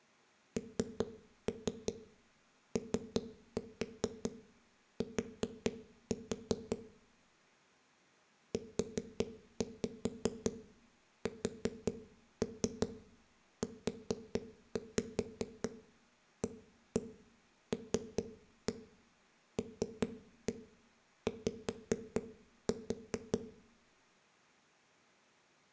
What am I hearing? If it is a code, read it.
Tap code, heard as knocks on a wall, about 5 knocks a second, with room echo. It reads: NOT USUALLY